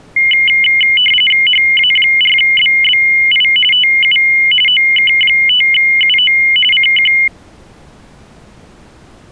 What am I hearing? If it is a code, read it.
RTTY (45.45 baud, 850 Hz shift), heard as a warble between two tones, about 2550 Hz centre. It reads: HA4BBI TU OK5UO CQ